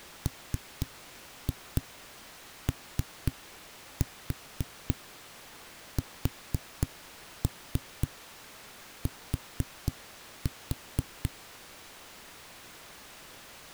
Tap code, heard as knocks on a wall, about 4 knocks a second. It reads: MOST